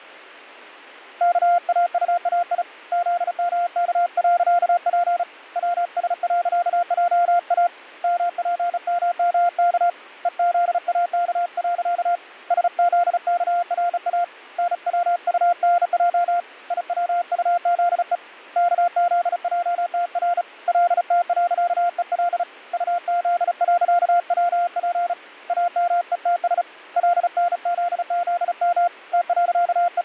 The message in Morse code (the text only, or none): KAUAI ZMK.P WS.JA MPMMK EZAK. SZKRA NWUNJ IWUZE KZJTR LT.EL UZ.WP AMETS LNZZM …